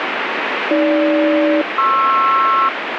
Aircraft SELCAL, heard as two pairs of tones, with radio static. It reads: AG-PR